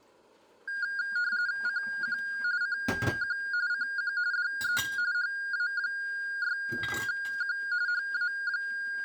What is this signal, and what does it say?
RTTY (45.45 baud, 170 Hz shift), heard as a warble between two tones, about 1500 Hz centre, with room echo and kitchen noise. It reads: CQ CQ CQ DE HA6Q …